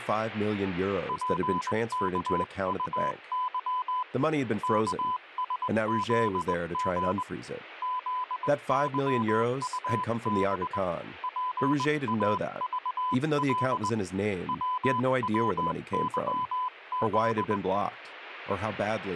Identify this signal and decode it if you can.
Morse code, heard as a keyed tone, hand-sent with a straight key, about 20 wpm, 1000 Hz, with speech in English. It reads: PKUY KSZG ZYUB PAVL WWYZ